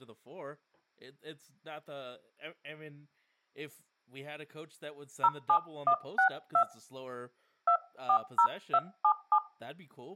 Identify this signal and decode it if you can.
DTMF, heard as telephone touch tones, dialled by hand, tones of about 80 ms, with speech in English. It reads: 07162 240277